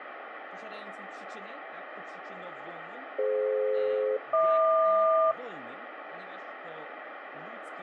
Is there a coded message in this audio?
Yes: aircraft SELCAL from 3.2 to 5.3 s, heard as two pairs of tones, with radio static and speech in Polish. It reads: DF-HQ